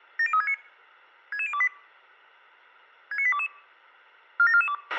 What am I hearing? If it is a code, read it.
Five-tone selective call (ZVEI), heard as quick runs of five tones, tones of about 70 ms, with a squelch burst at the end. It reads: 70369 66028 69822 47442